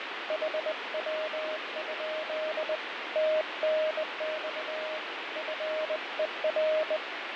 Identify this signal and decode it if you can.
Morse code, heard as a keyed tone, hand-sent with a bug key, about 20 wpm, 620 Hz, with heavy radio static and fading. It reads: HW? TNX FER